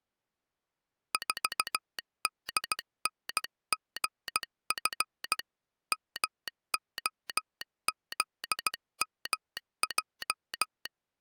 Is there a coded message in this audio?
Yes: Morse code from 1.1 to 10.9 s, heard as a telegraph sounder, hand-sent with a paddle, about 16 wpm. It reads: 4DNGF MOZMJ